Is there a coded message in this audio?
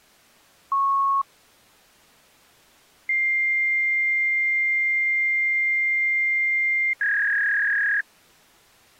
Yes: fax machine handshake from 0.7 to 8.0 s, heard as a beep, a long tone and a warble.